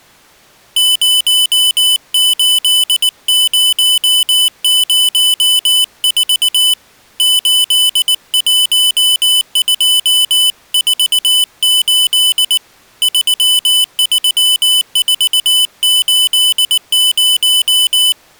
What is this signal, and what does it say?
Morse code, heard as a high beeper, hand-sent with a paddle, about 19 wpm, 3000 Hz. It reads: 08004 81248 33480